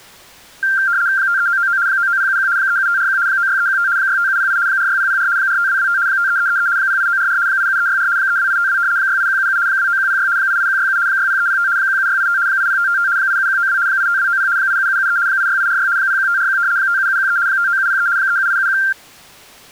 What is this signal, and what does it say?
RTTY (75 baud, 170 Hz shift), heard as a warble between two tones, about 1480 Hz centre. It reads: 53999 99071 37541 96315 65708 46004 45225 53333 08944 87364 32852 68177 29106 88167 60305 17685 80555 87192 85290 87773 86846 01541 57713 59703 37871